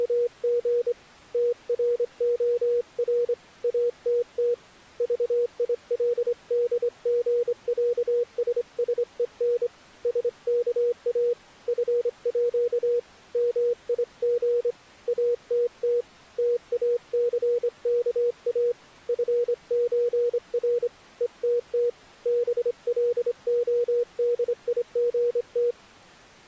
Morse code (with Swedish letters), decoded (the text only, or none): … TROR ATT VILDGÄSSEN SKA FÅ MIG ATT TACKA FÖR ETT BLODIGT